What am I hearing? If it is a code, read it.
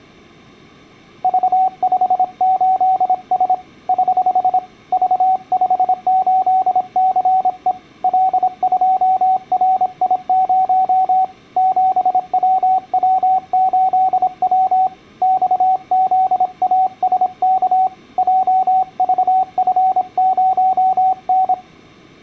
Morse code, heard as a keyed tone, hand-sent with a paddle, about 26 wpm, 760 Hz. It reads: V58S <HH> V58CE L2RI0 7WW8W XZASK JVF0N